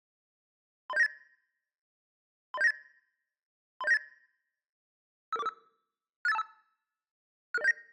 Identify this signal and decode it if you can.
Five-tone selective call (EIA), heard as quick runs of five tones, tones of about 30 ms. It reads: 30798 30798 30798 55445 68525 66079